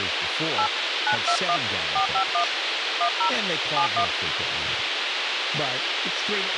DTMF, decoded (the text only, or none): 8 921 451 10 71